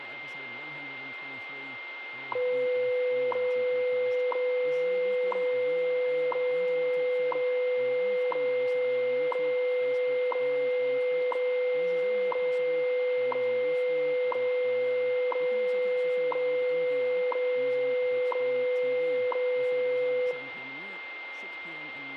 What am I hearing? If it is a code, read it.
Radio time signal (WWV, Colorado), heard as ticks, one a second, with radio static, a steady whistle near 2100 Hz, room echo and speech in English.